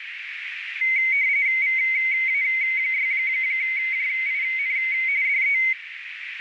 RTTY (45.45 baud, 170 Hz shift), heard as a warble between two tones, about 2150 Hz centre, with radio static and a narrow filter. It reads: VA6JIN DE